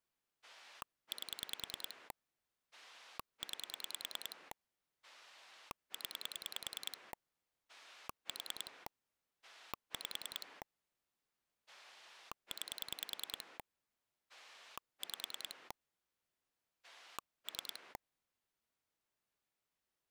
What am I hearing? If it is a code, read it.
Pulse dialling, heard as a rotary dial, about 10 pulses a second. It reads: 8 9 0 4 5 9 5 3